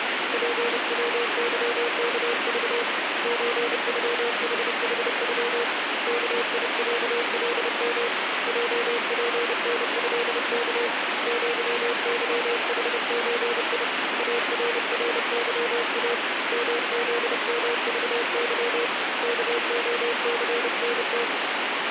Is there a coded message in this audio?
Yes: Morse code (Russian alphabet) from 0.3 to 21.3 s, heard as a keyed tone, hand-sent with a paddle, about 30 wpm, 470 Hz, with heavy radio static. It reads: ПВЫКЖ ЧЮХХЮ КИЯЛМ ЙПНЭК ЪЫХЧИ АРРЫА МЗМЖЫ КОЦНТ